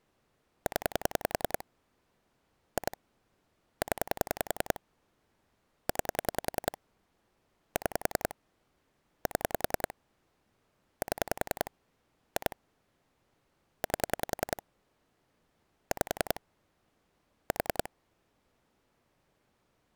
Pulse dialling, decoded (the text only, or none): 0 2 0 9 6 7 7 2 8 5 4